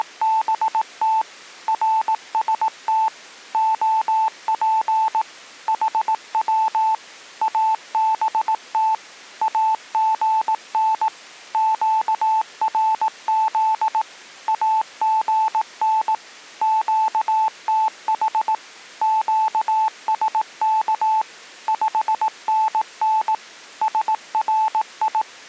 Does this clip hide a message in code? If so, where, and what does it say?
Yes: Morse code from 0.0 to 25.3 s, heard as a keyed tone, machine-sent, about 18 wpm, 880 Hz. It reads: … RST OP HW ABT AGN QRZ AGN QTH QSK 5NN SRI